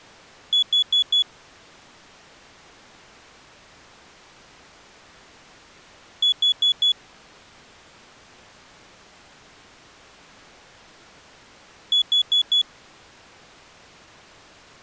Alarm pattern, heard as an alarm's beeps, played three times, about 3400 Hz. Temporal four. Carbon monoxide.